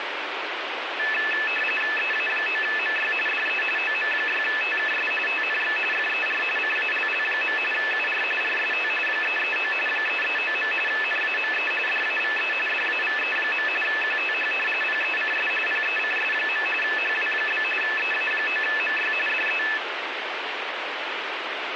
RTTY (45.45 baud, 850 Hz shift), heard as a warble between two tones, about 2150 Hz centre, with radio static. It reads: EA9MY DE OM6TKS TNX FER CALL. UR RST 339 339. NAME DAVE DAVE. QTH PECS PECS. HW? EA9MY DE